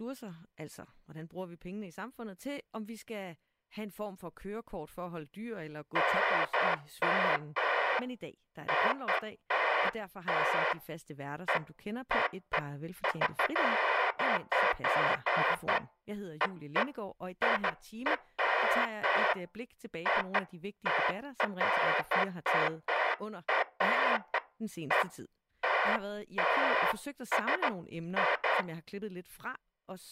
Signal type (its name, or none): none